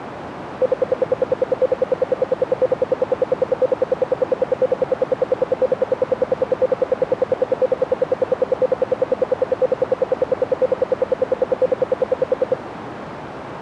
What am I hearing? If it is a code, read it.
Radio time signal (RWM, Moscow), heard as ten pulses a second, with radio static.